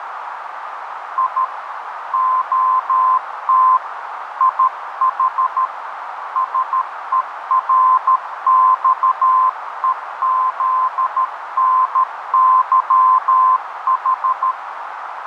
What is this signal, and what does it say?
Morse code (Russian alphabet), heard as a keyed tone, hand-sent with a paddle, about 13 wpm, 1030 Hz, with radio static and a narrow filter. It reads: И ОТ ИХ СЕРЬЕЗНЫХ